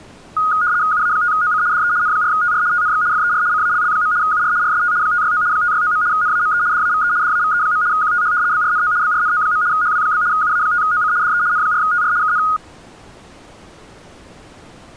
RTTY (75 baud, 170 Hz shift), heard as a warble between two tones, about 1340 Hz centre. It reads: UA5OC DE N4TR TNX FER CALL. UR RST 569 569. NAME DAVE DAVE. QTH BRNO BRNO. HW? UA5OC DE N4TR KN